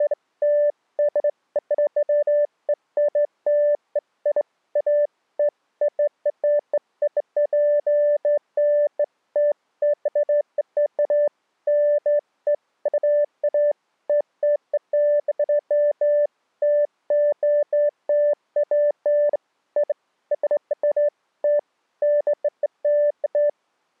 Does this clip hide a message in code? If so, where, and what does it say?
No, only beeps of irregular length.